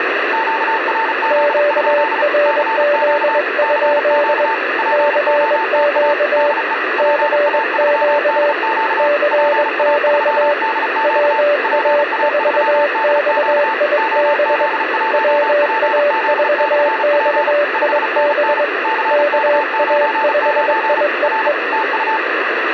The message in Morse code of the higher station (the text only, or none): QRZ? CQ CQ POTA DE PA3DQ PA3DQ PA3DQ OZ1PZ/P 5NN CK99 R TU